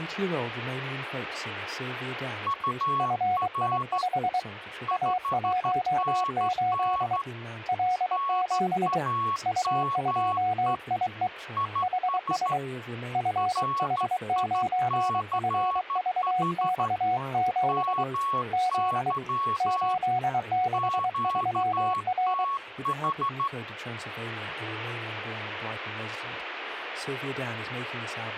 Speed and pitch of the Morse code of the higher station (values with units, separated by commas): 13 wpm, 1110 Hz